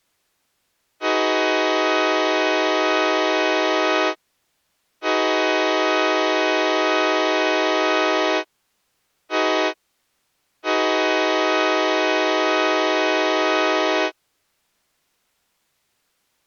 Train horn signal, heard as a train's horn. 2 long, 1 short, 1 long. On North American railways: approaching a public crossing.